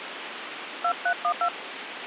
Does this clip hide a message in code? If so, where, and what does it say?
Yes: DTMF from 0.8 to 1.5 s, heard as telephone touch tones, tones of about 80 ms, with phone line noise. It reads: 2312